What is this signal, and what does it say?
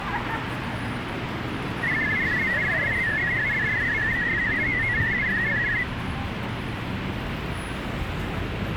Multi-tone FSK (Olivia or MFSK type), about 500 Hz wide, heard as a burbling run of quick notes, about 62.5 baud, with radio static and street noise.